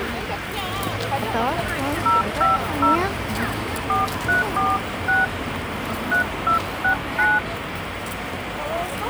DTMF, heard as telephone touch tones, dialled by hand, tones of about 150 ms, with phone line noise and the noise of a residential street. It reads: 050 4346 3269